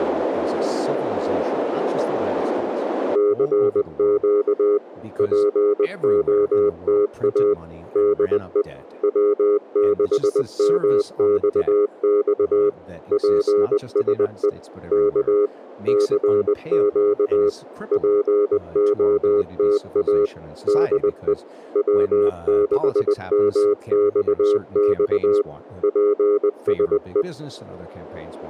Morse code, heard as a keyed tone, machine-sent, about 20 wpm, 410 Hz, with radio static and speech in English. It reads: CQ POTA DE W6MXX PSE K CQ POTA DE W6MXX PSE